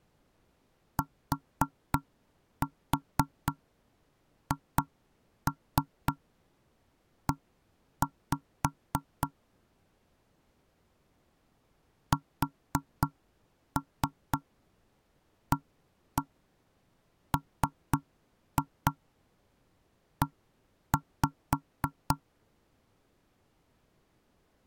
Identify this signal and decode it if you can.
Tap code, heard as knocks on wood, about 3 knocks a second. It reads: THE SAME